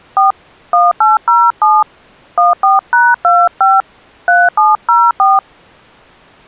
DTMF, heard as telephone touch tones, dialled by hand, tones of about 190 ms. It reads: 4 1807 14#25 3704